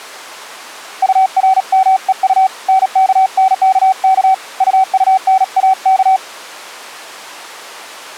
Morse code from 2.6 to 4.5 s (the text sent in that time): NKNKK